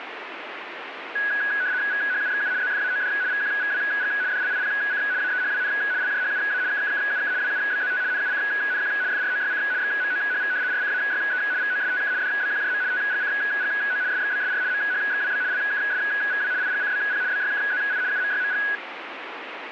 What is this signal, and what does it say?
RTTY (75 baud, 170 Hz shift), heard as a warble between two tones, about 1550 Hz centre, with radio static. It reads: VHUXU ZFAOD VQVWG DLIPC AEHWN LJHUA KKKUK WUBZT NUCNQ FROYC XMOHV RCAYE VOSTK DBQJM TGCGO SXBSR MHXWB LKSVW IGCBP BYKZI UMYMG